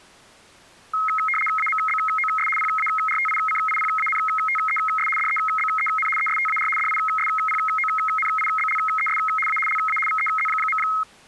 RTTY (75 baud, 850 Hz shift), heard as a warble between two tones, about 1700 Hz centre. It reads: AMBOS PARTICIPANTES DEBEN ESTAR DISPONIBLES A LA VEZ.